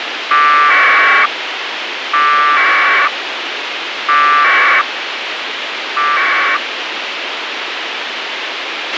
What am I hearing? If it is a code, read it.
Packet radio (AX.25, as in APRS), 1200 baud, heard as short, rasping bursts, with radio hiss and a squelch burst at the end.